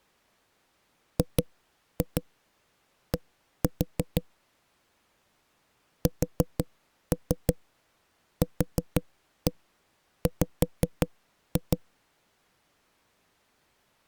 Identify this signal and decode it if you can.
Tap code, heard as knocks on a wall, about 5 knocks a second. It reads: GD SQW